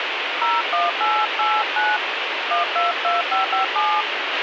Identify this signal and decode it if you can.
DTMF, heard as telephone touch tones, dialled by hand, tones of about 180 ms, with radio hiss and a squelch burst at the end. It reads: 01889 122557